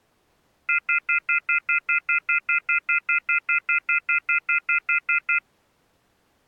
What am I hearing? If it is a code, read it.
Telephone call progress tone (North American plan), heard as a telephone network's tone, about 1400, 2050, 2450, 2600 Hz, 0.1 s on and 0.1 s off. Off-hook warning tone.